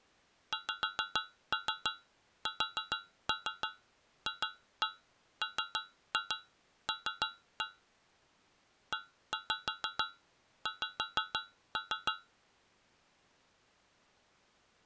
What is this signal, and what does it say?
Tap code, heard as taps on a metal pipe, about 6 knocks a second. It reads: XSFML EX